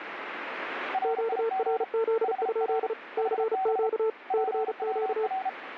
Morse code, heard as two keyed tones, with radio static. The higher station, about 33 wpm, 760 Hz: RIG HR HB PWR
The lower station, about 35 wpm, 450 Hz: QRZ? CQ CQ